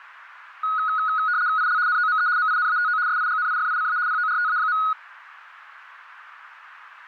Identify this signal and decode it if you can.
RTTY (75 baud, 170 Hz shift), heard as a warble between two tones, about 1360 Hz centre, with radio static. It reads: IL NOME MINATO SIGNIFICA PORTA.